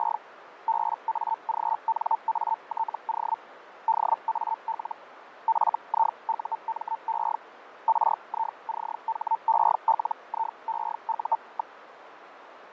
Hellschreiber (Feld-Hell, 122.5 baud), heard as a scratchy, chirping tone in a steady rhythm, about 900 Hz, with radio static and fading. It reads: … BAGNATO DAL FIUME RICHELIEU.